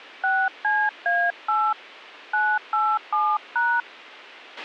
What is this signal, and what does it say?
DTMF, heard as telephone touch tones, dialled by hand, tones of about 250 ms, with a squelch burst at the end. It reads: 6CA8 987#